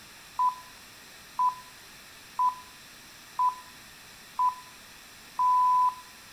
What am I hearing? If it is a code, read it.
Radio time signal (six pips, as the Greenwich Time Signal), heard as pips, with room echo.